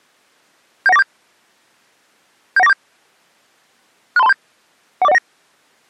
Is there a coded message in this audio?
Yes: five-tone selective call (EIA) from 0.9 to 5.2 s, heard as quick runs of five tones, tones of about 30 ms. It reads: 71947 71947 63237 14019